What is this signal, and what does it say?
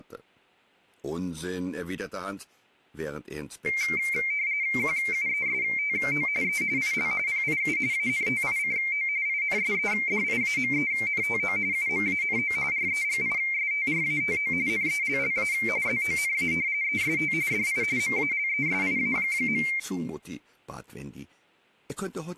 RTTY (45.45 baud, 170 Hz shift), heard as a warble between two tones, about 2200 Hz centre. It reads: QUESTO E IL PIU ANTICO INSEDIAMENTO UMANO REGISTRATO NELLA ZONA EST DI MALESIA.